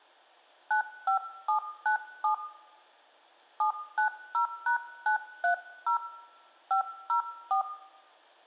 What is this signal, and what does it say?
DTMF, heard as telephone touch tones, dialled by hand, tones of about 110 ms, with room echo. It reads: 95797 790#930 504